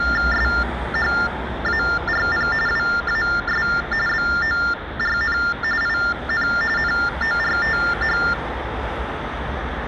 TTY/TDD text telephone tones (45.45 baud Baudot), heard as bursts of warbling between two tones, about 400 Hz shift, 1600 Hz centre, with phone line noise and street noise. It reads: SHARP WAS BORN IN NORTH